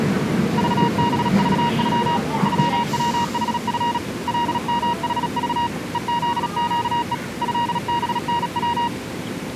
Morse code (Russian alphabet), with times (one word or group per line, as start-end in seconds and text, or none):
0.6-2.2 ЖБЖЮ
2.5-4.0 ЮВХФ
4.3-5.7 ЛМХЖ
5.9-7.1 ЕЗЩЕ
7.4-8.9 ЭБНВ